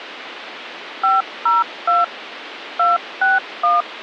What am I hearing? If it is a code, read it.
DTMF, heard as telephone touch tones, dialled by machine, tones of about 170 ms, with phone line noise. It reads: 502 261